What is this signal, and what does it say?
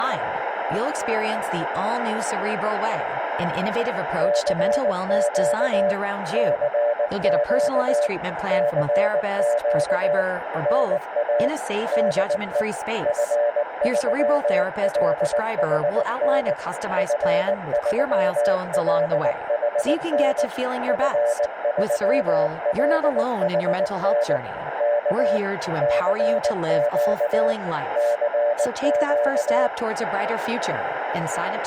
Morse code, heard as a keyed tone, machine-sent, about 19 wpm, 590 Hz, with radio static, a narrow filter and speech in Swedish. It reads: CQ CQ CQ NA DE F3LHN F3LHN F3LHN K CQ CQ